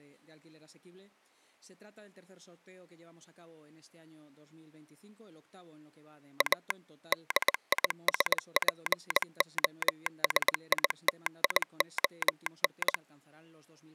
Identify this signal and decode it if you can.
Morse code, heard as a telegraph sounder, machine-sent, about 20 wpm. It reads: A DISPOSITION